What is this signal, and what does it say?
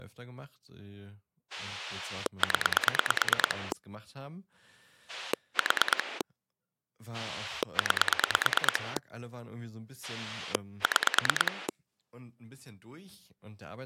Pulse dialling, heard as a rotary dial, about 9 pulses a second, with speech in German. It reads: 0 4 9 6